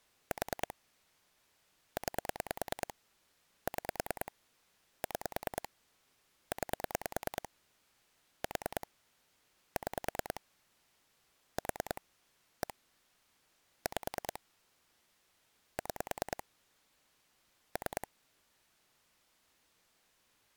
Pulse dialling, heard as clicks on a phone line, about 9 pulses a second. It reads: 4 9 6 6 9 4 6 4 1 5 6 3